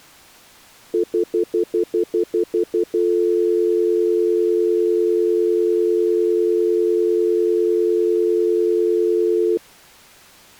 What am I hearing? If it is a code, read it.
Telephone call progress tone (North American plan), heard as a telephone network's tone, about 350, 440 Hz, 0.1 s on and 0.1 s off. Stutter dial tone.